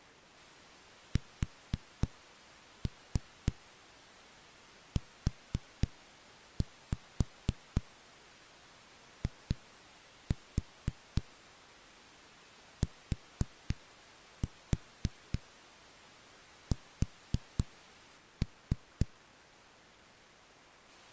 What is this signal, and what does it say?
Tap code, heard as knocks on a wall, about 3 knocks a second. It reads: SUITS